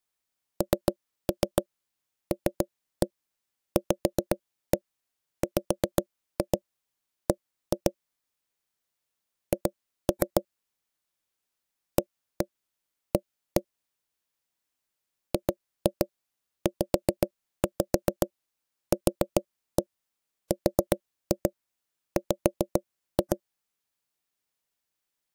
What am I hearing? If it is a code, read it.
Tap code, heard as knocks on wood, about 7 knocks a second. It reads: NLVWB H AA GZQRW